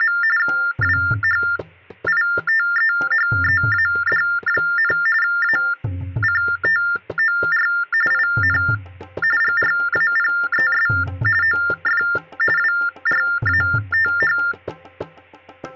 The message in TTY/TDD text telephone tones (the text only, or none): … WHITEHEAD, ACTOR IN GRAPES OF WRATH